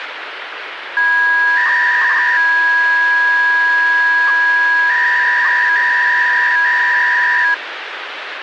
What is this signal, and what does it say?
300-baud modem data (V.21 tones), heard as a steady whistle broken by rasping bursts, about 300 baud, 200 Hz shift, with phone line noise.